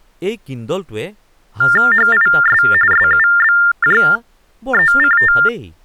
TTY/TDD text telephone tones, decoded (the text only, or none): HIS SUBJECT